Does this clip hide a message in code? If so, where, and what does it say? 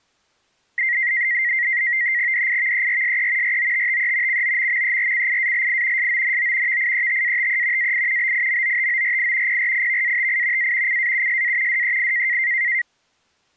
Yes: NAVTEX (SITOR-B), 100 baud, 170 Hz shift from 0.8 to 12.8 s, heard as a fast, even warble, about 2000 Hz centre. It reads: DIVERSE ROTTE COMMERCIALI SONO VIETATE AI BIMOTORI PRIVATI A CAUSA DEI